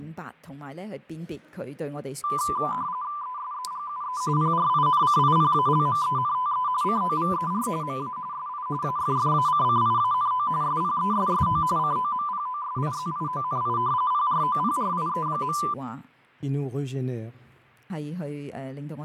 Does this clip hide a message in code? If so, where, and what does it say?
Yes: RTTY (45.45 baud, 170 Hz shift) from 2.2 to 15.7 s, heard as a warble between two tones, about 1090 Hz centre, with fading. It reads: ESEGUE PRINCIPALMENTE COVER MA SI AFFACCIANO SPESSO COMPOSIZIONI PROPRIE.